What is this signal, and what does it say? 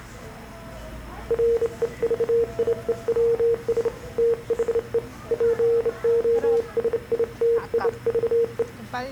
Morse code, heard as a keyed tone, hand-sent with a straight key, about 28 wpm, 460 Hz, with the noise of a crowd indoors. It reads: REVIEWS THE POSITIVE